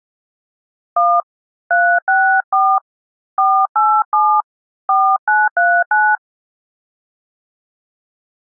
DTMF, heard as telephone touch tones, dialled by hand, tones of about 260 ms. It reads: 1 364 487 4939